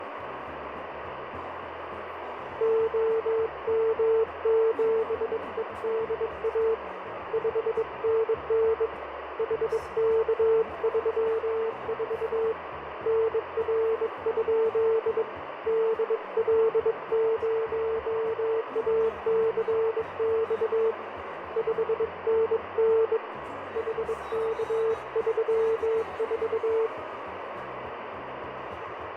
Morse code, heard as a keyed tone, hand-sent with a bug key, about 22 wpm, 450 Hz, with radio static. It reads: OM7EDA 5NN HK34 NR? DL0ACX 5NN HK34